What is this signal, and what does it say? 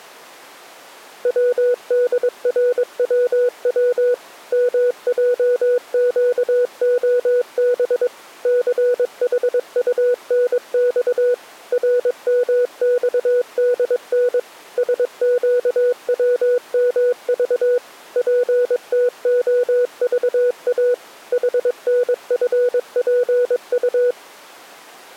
Morse code, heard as a keyed tone, machine-sent, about 22 wpm, 490 Hz. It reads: WDRWW MJQOB CHUNX RMXDN SQWMV PTOVA HNFPU